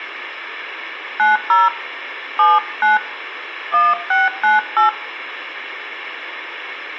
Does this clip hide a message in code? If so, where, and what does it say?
Yes: DTMF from 1.2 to 4.9 s, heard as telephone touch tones, dialled by hand, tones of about 170 ms, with room echo. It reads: 90 79 1698